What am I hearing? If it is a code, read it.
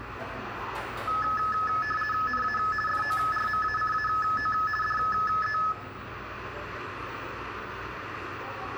RTTY (50 baud, 450 Hz shift), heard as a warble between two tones, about 1500 Hz centre, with radio static, room echo and the noise of a cafe. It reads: NA FORMACAO DE